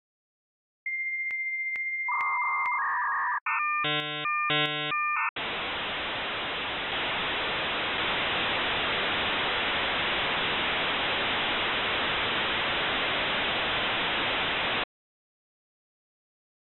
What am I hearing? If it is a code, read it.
Dial-up modem handshake (V.34 or later), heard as a whistle, warbles, then hiss.